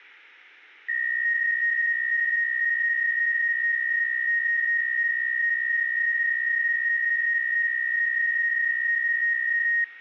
PSK63 (62.5 baud), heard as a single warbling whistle, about 1850 Hz.